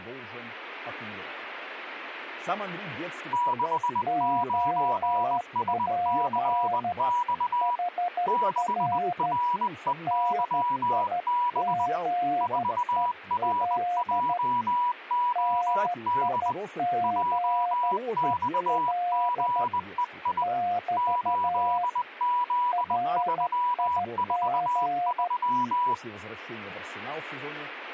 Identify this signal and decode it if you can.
Morse code, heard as two keyed tones, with speech in Russian. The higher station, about 20 wpm, 980 Hz: 69SCX 6REYB 4RJOD JXGEI 8Z343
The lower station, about 13 wpm, 710 Hz: OP HR NIGEL NIGEL <BT> RIG